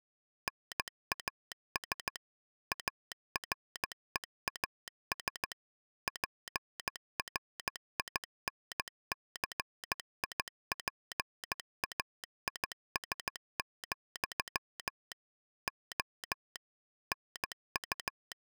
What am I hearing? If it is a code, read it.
Morse code, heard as a telegraph sounder, machine-sent, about 15 wpm. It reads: NAS AREAS PRINCIPAIS, O …